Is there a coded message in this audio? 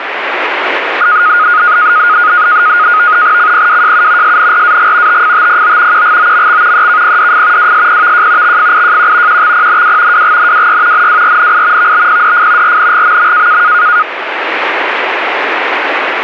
Yes: NAVTEX (SITOR-B), 100 baud, 170 Hz shift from 1.0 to 14.0 s, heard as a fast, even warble, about 1340 Hz centre, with radio static. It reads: CPWJU SNRAG TFTPO QGOMX EKPDF WSPVJ XFIJQ QXPNW WGNWY NWRNI VBPDF RNGMM